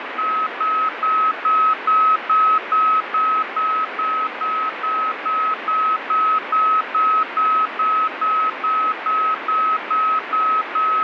Evenly repeated beeps, with radio static. There is no code.